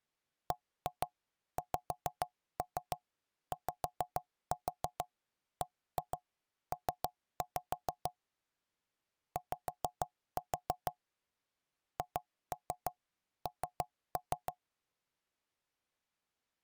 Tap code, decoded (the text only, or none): BXYBP Y HN